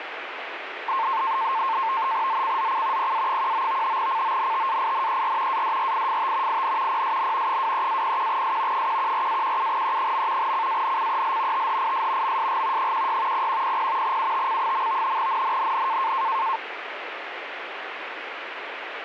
NAVTEX (SITOR-B), 100 baud, 170 Hz shift, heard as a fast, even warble, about 980 Hz centre, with radio static. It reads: ZCZC PA19 CONTAINER ADRIFT IN PSN 23-01S 114-17E. CANCEL THIS MSG 16 0100 UTC. NNNN